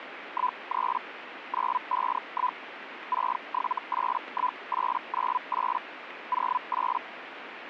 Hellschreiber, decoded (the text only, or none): 13 951 6781898 08